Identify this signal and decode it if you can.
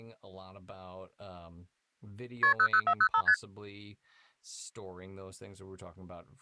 Multi-frequency trunk signalling (R1, as on North American trunks), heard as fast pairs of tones, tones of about 70 ms, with speech in English. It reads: KP 00405 ST